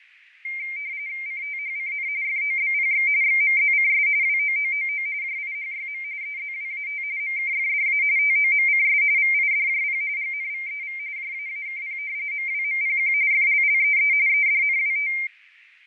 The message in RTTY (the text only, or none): CTHCN FOBPX XMZCS WOOOO JIHYM EZWAT MKFDA TOMCS VIDJP GNVEV JAAKP MWMPQ FLLEE EDNWT